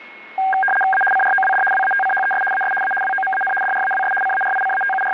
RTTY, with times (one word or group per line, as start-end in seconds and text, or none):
0.9-1.0 A
1.1-1.6 CROWD
1.7-2.4 WATCHES
2.5-2.7 AS
2.8-2.9 A
3.0-3.5 WOMAN
3.6-4.1 DRAWS
4.2-5.1 …